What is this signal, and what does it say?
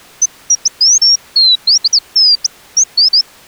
Bird-like chirps. There is no code.